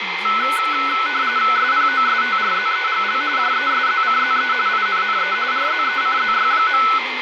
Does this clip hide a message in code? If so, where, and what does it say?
Yes: RTTY (45.45 baud, 170 Hz shift) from 0.2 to 7.0 s, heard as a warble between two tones, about 1400 Hz centre, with radio static, a steady whistle near 2090 Hz, room echo and speech in Kannada. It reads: SPOSTRZEGL JESZCZE INNE RZECZY.